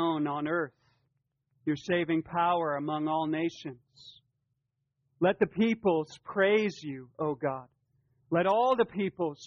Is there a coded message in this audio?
No.